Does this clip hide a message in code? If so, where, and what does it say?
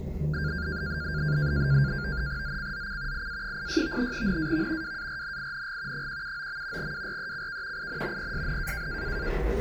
Yes: NAVTEX (SITOR-B), 100 baud, 170 Hz shift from 0.3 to 9.3 s, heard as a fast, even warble, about 1500 Hz centre, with the noise inside a lift. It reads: ZCZC IA86 NAV WARNING 179. WRECK IN PSN